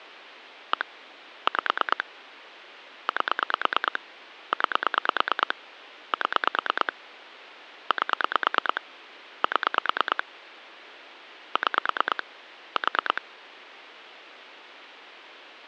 Pulse dialling, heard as clicks on a phone line, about 9 pulses a second, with phone line noise. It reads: 1 5 8 9 7 8 7 6 4